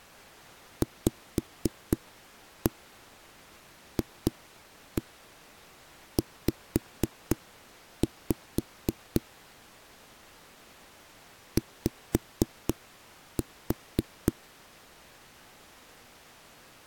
Tap code, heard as knocks on a wall, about 4 knocks a second. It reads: VFZ Y